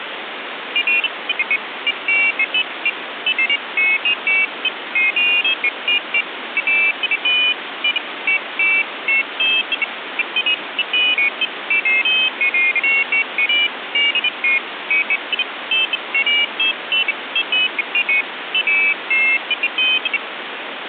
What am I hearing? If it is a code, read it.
Pairs of high tones at irregular times, with phone line noise. There is no code.